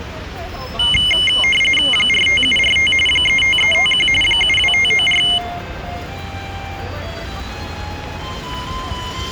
RTTY (45.45 baud, 850 Hz shift), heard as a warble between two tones, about 2550 Hz centre, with the noise of a residential street. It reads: 45745 35351 72594